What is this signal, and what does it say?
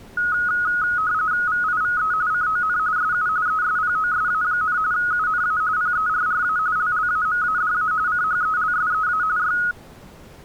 RTTY (45.45 baud, 170 Hz shift), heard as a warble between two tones, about 1360 Hz centre. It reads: VIVE CON SU ESPOSA, UNA PERRA LLAMADA CHELSEA Y